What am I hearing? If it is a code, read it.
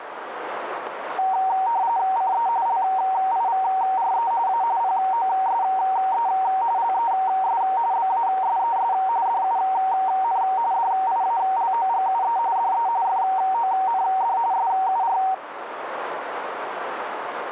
RTTY (45.45 baud, 170 Hz shift), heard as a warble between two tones, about 840 Hz centre, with radio static and a narrow filter. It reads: CE LIVRE A POSE LES BASES DUN DIALOGUE DE FOND SUR